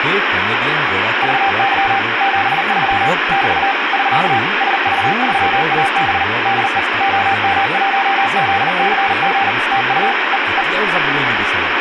Morse code, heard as a keyed tone, machine-sent, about 39 wpm, 790 Hz, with radio static and speech in Assamese. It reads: VY 73 <BT> <SK> SV3AB DE OM1ZCG TU E E